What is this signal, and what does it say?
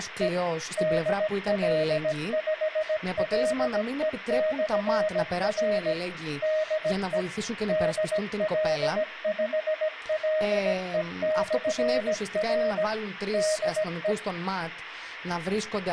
Morse code, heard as a keyed tone, machine-sent, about 17 wpm, 620 Hz, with speech in Greek. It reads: … DL5LE/R DE DL5LE/R DE